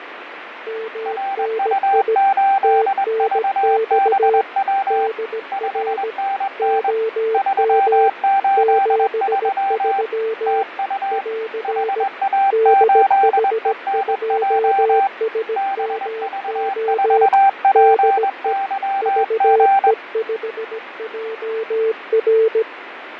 Morse code, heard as two keyed tones, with radio static and fading. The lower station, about 17 wpm, 450 Hz: MNI TNX DR OM 73 <AR> DH2SMO DE VE5JR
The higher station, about 21 wpm, 780 Hz: RU8VBW 5NN 383 TU HA8ENJ BV4PYG